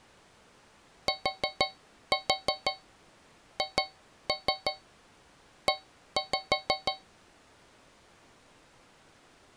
Tap code, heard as taps on a metal pipe, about 6 knocks a second. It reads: THE